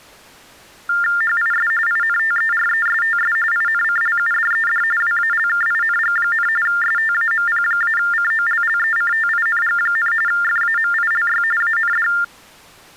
TTY/TDD text telephone tones (45.45 baud Baudot), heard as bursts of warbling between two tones, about 400 Hz shift, 1600 Hz centre. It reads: HIS INTERESTS INCLUDED WALKING, STAMP-COLLECTING, FAMILY AND